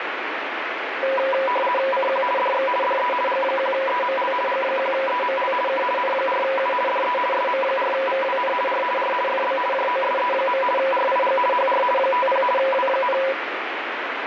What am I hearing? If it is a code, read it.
RTTY (50 baud, 450 Hz shift), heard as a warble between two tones, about 760 Hz centre, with radio static. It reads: CQ DX DE G1EML G1EML K N4U DE SM4VWN R R FB JOSE. RIG HR 50 W,